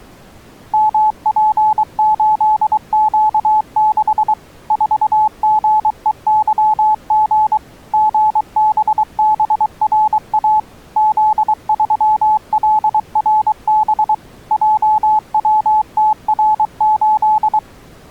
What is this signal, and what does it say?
Morse code, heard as a keyed tone, machine-sent, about 23 wpm, 860 Hz. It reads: MP8Q6 4GEYG GBBRA Z3LRB JWTR8